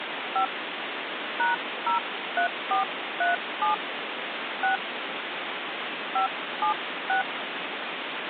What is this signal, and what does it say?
DTMF, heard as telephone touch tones, dialled by hand, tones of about 120 ms, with phone line noise. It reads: 5 #03437 6 576